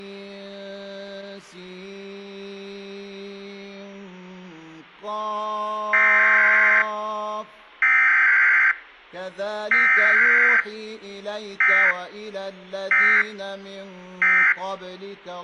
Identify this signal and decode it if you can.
Emergency Alert System (SAME) tones (header bursts, then end-of-message bursts), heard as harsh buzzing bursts, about 520.83 baud.